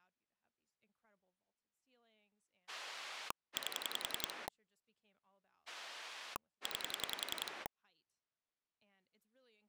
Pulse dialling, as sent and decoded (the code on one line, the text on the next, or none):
8 / 9
8 9